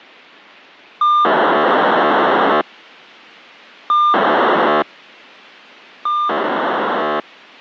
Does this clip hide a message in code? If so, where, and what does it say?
Yes: POCSAG pager data (2400 baud) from 1.0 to 7.2 s, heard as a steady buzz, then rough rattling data.